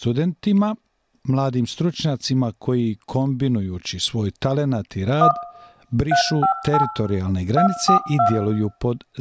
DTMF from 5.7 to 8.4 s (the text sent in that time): 358 242